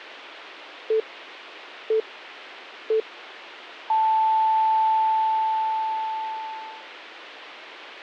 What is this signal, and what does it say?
Radio time signal (three low pips and a long one an octave up, as on NHK), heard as pips.